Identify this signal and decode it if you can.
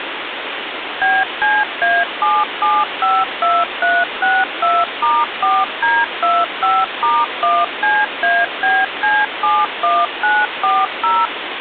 DTMF, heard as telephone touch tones, dialled by machine, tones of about 220 ms, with phone line noise. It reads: BCA7752362*4D25*1CABC71940